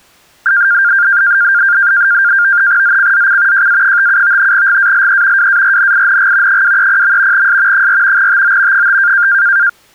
NAVTEX (SITOR-B), 100 baud, 170 Hz shift, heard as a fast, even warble, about 1500 Hz centre. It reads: ZCZC JA57 GALE WARNING 230. S 4 TO 5